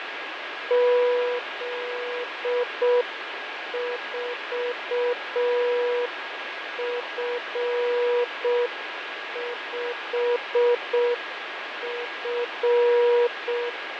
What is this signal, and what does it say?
Morse code, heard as a keyed tone, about 6 wpm, 480 Hz, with radio static, fading and a steady whistle near 1640 Hz. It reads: Z4F5F